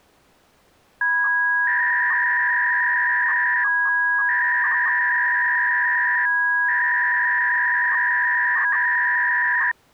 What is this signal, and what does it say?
300-baud modem data (V.21 tones), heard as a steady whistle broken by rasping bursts, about 300 baud, 200 Hz shift.